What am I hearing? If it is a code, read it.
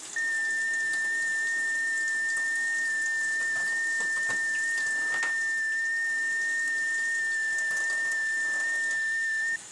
FT8 (one signal), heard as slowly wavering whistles, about 6.25 baud, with kitchen noise.